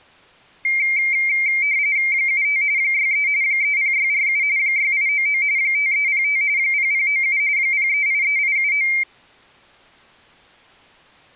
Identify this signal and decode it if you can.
RTTY (45.45 baud, 170 Hz shift), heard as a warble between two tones, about 2200 Hz centre. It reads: 75 63 30647 6899 5305 0097 0383879